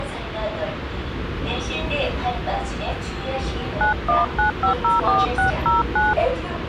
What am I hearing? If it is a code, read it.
DTMF, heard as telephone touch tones, dialled by hand, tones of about 140 ms, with phone line noise and the noise inside a subway train. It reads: 919504609